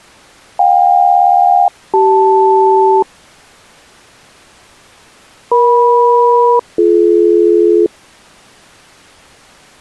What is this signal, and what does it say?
Aircraft SELCAL, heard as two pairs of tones. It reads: JK-CL EM-BD